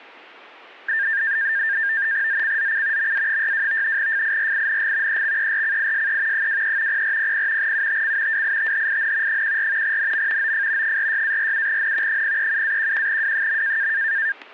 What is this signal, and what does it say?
NAVTEX (SITOR-B), 100 baud, 170 Hz shift, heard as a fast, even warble, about 1700 Hz centre, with static crashes. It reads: ZCZC MA62 FIRING EXERCISE 23 0400 UTC WITHIN 14 NM OF 46-47N 037-11W.